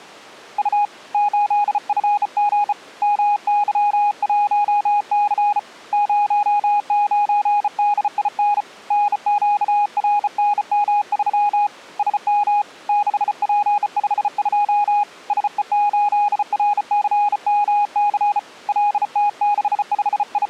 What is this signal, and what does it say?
Morse code, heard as a keyed tone, hand-sent with a bug key, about 34 wpm, 830 Hz. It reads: U 8FG MY1C 09DIN NQRNM3 SM 6P52 SE8RCMC …